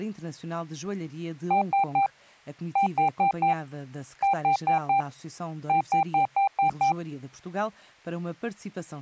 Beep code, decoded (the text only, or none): 3-4-4-6